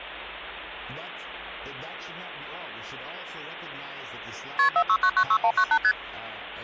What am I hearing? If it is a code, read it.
Multi-frequency trunk signalling (R1, as on North American trunks), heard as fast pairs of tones, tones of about 70 ms, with hum. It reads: KP 46996198 ST